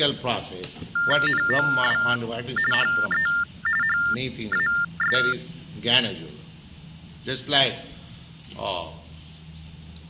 TTY/TDD text telephone tones (45.45 baud Baudot), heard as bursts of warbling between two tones, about 400 Hz shift, 1600 Hz centre. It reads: NOW HE HAS